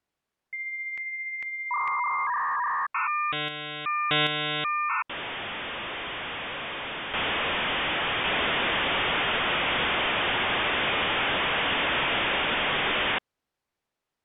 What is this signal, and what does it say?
Dial-up modem handshake (V.34 or later), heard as a whistle, warbles, then hiss.